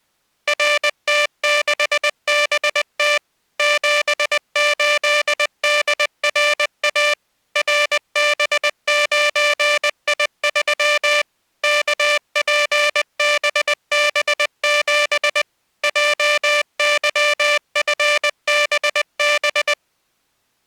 Morse code, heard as a buzzer, machine-sent, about 20 wpm. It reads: RT6BT 78DRA RB9I3 KPBB7 JYFBB